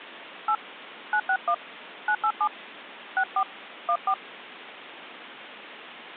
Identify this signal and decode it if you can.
DTMF, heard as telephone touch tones, dialled by hand, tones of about 70 ms. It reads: 8 961 987 64 14